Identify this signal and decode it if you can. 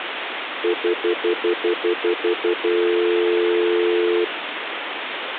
Telephone call progress tone (North American plan), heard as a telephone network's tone, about 350, 440 Hz, 0.1 s on and 0.1 s off, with phone line noise. Stutter dial tone.